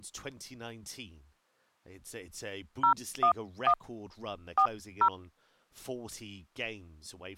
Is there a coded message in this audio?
Yes: DTMF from 2.8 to 5.1 s, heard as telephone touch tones, dialled by hand, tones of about 80 ms, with speech in English. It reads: 011 40